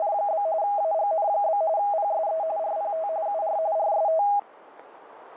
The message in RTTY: … AGN? PSE RPT UR RST

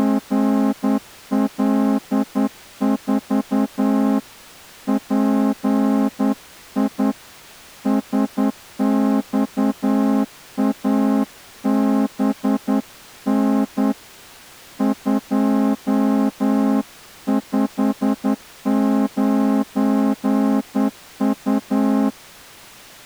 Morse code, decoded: … PI SXABN 259U

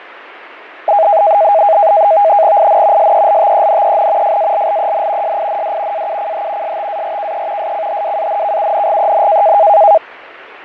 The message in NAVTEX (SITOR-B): IN SELTENEN FALLEN SIND AUCH STARKE SCHWANKUNGEN

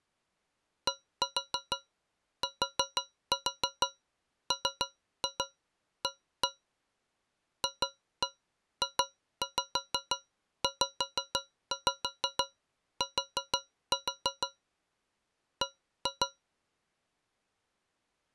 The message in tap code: DTMA FJZT B

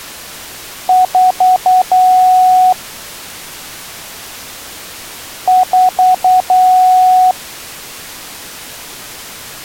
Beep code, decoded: 4 short, 1 long

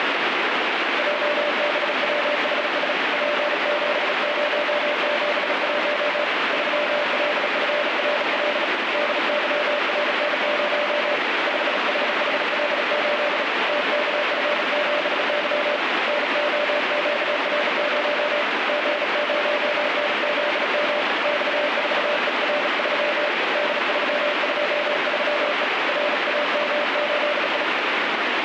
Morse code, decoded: JBWHS P7071 3LFRL DYRN0 5HHL8 TKF7Y NOQR0 G0NZM X4ER3 D323E RAM8I

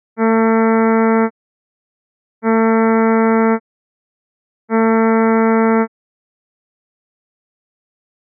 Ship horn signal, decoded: 3 short

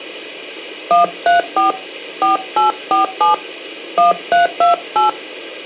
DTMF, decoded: 134 4847 1328

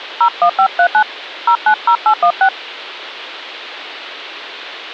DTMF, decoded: 01539 090816

